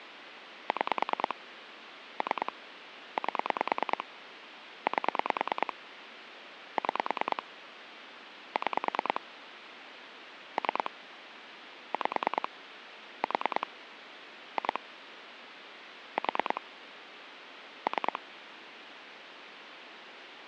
Pulse dialling, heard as clicks on a phone line, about 9 pulses a second, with phone line noise. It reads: 6 3 8 8 6 6 3 5 4 2 4 3